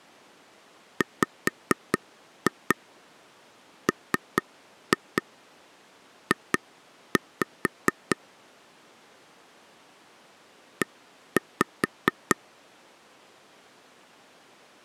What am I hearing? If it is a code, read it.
Tap code, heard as taps on a table, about 4 knocks a second. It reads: WMJ E